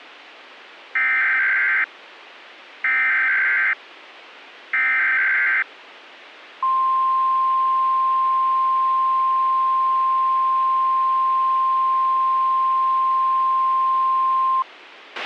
Emergency Alert System (SAME) tones (header bursts, then the 1050 Hz attention tone), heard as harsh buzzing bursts, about 520.83 baud, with a squelch burst at the end.